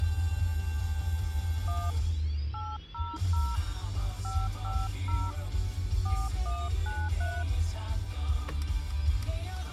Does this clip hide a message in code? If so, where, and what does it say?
Yes: DTMF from 1.7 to 7.4 s, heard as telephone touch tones, dialled by hand, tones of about 230 ms, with the noise inside a car. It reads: 1 800 550 4193